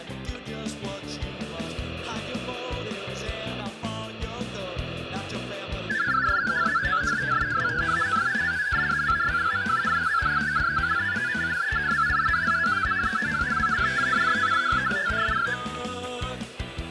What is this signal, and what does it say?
Multi-tone FSK (Olivia or MFSK type), about 500 Hz wide, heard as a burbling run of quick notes, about 62.5 baud, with static crashes.